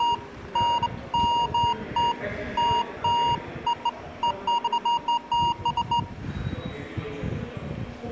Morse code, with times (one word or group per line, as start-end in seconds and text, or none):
none